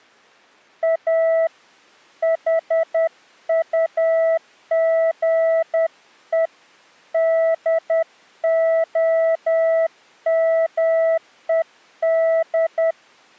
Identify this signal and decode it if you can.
Morse code, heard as a keyed tone, hand-sent with a paddle, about 10 wpm, 650 Hz. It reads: A HUGE DOMED